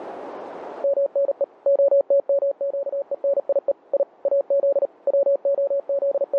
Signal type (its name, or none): Morse code